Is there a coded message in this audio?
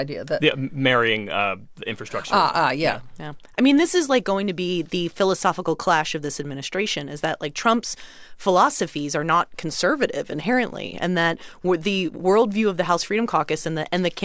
No, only speech in English.